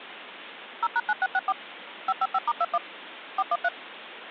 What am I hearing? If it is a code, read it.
DTMF, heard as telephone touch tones, dialled by machine, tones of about 40 ms, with phone line noise. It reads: 0#9664 555*21 413